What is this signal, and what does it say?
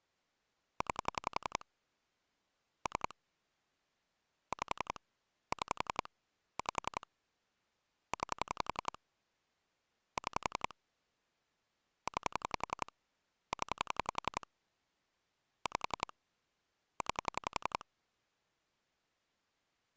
Pulse dialling, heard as clicks on a phone line, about 11 pulses a second. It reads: 9 3 5 6 5 9 6 9 0 5 9